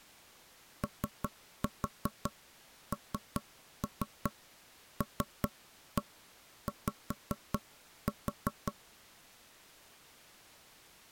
Tap code, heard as knocks on wood, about 5 knocks a second. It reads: ONLY